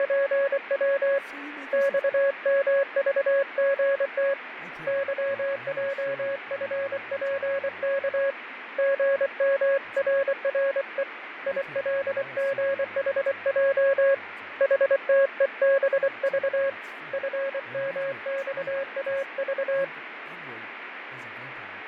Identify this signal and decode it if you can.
Morse code, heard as a keyed tone, hand-sent with a paddle, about 24 wpm, 550 Hz, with radio static, fading and speech in English. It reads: … XMVGT YJFPK GMRRE ILGHJ HTEBV FMXAV